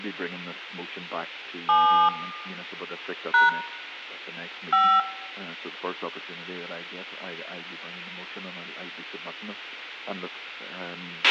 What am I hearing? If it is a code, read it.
DTMF, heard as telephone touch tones, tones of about 280 ms, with a squelch burst at the end and room echo. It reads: 7 # 5